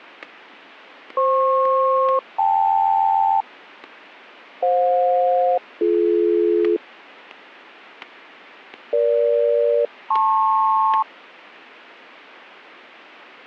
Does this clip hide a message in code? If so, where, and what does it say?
Yes: aircraft SELCAL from 1.2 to 11.0 s, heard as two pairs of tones, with static crashes. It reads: FP-KL FJ-BD EG-LP